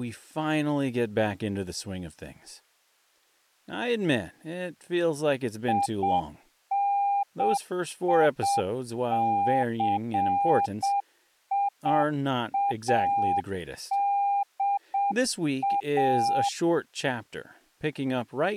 Morse code, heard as a keyed tone, machine-sent, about 7 wpm, 800 Hz, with speech in English. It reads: INICIADA